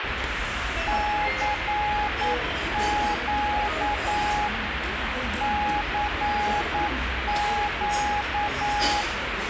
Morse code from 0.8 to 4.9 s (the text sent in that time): CQ